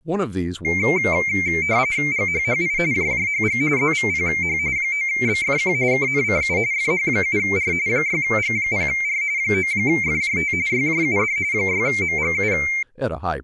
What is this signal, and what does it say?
RTTY (45.45 baud, 170 Hz shift), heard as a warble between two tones, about 2200 Hz centre, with speech in English. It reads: GHHI JJHG ZVPH 9BFQ KNCU FH7R 6G0R 9FJT YJUD 6MGU